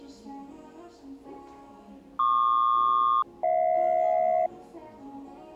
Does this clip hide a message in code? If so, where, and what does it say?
Yes: aircraft SELCAL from 2.2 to 4.5 s, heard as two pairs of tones, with the noise of a cafe. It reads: PQ-HJ